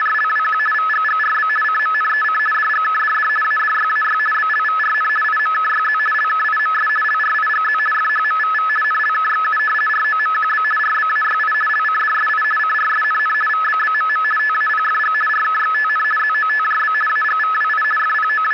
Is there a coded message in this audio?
Yes: RTTY (50 baud, 450 Hz shift) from 0.0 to 18.5 s, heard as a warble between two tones, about 1500 Hz centre, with radio static and static crashes. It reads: … VGGRB CMNEC DGKDD ADYAY BLVRN IMKYZ LKIMS LRIGZ FHMVV NLKXU ROMQB RBAYI LCDSI CRSNN VBBMM TAPFG RKXTN ZOTJB AGVWI …